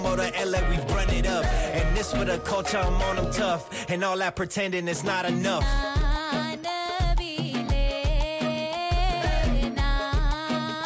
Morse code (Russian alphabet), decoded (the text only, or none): none